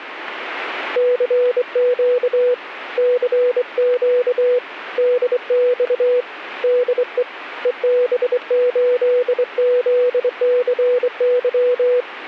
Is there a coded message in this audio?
Yes: Morse code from 0.9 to 12.1 s, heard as a keyed tone, hand-sent with a straight key, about 24 wpm, 490 Hz. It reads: CQ CQ DX DE EB8ZCY